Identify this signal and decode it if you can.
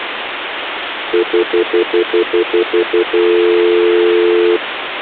Telephone call progress tone (North American plan), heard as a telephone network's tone, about 350, 440 Hz, 0.1 s on and 0.1 s off, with phone line noise. Stutter dial tone.